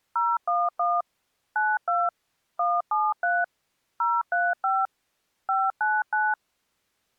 DTMF, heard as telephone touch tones, dialled by machine, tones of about 210 ms. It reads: 011 92 173 035 599